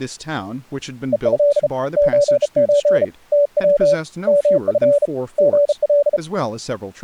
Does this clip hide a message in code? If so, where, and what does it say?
Yes: Morse code (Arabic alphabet) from 1.1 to 6.2 s, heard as a keyed tone, hand-sent with a bug key, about 34 wpm, 580 Hz, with speech in English. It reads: ءه زز تو مف غل